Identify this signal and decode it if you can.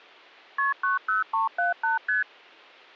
Multi-frequency trunk signalling (R1, as on North American trunks), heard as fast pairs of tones, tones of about 140 ms. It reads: KP 90378 ST